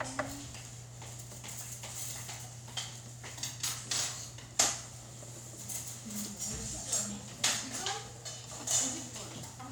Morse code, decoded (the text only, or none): none